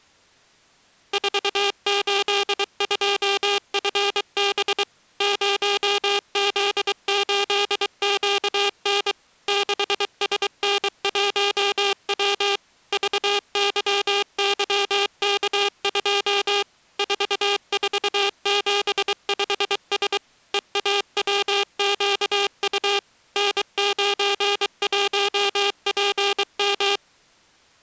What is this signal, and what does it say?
Morse code, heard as a buzzer, machine-sent, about 23 wpm. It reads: 482FB 0Z8QN 6SN1W VYYK2 4475S EAWQU N91PM